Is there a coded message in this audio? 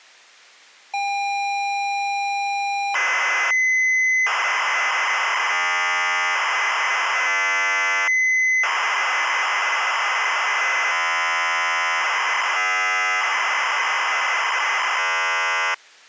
Yes: ZX Spectrum tape loading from 0.9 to 15.7 s, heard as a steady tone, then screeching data.